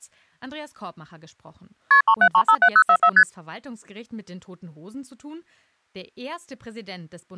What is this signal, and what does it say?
Multi-frequency trunk signalling (R1, as on North American trunks), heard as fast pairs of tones, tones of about 70 ms. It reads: KP 37357044 ST